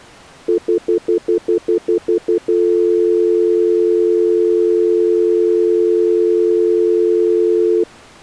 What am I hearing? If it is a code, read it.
Telephone call progress tone (North American plan), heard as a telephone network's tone, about 350, 440 Hz, 0.1 s on and 0.1 s off. Stutter dial tone.